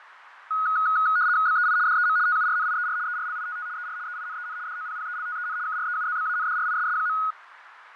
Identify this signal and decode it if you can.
RTTY (75 baud, 170 Hz shift), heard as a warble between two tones, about 1360 Hz centre, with radio static, fading and a narrow filter. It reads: BEI DEM TURNIER ERLITT ER EINEN DOPPELTEN KREUZBANDRISS.